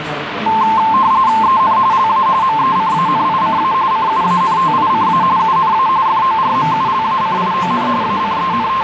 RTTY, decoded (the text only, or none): EN LA MECANICA CUANTICA UNA FORMULACION …